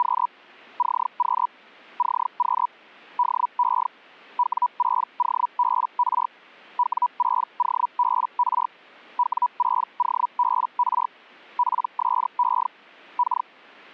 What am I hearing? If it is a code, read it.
Hellschreiber (Feld-Hell, 122.5 baud), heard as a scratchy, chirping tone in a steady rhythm, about 980 Hz. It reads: … CQ CQ DE W6OBR W6OBR W6OBR PSE K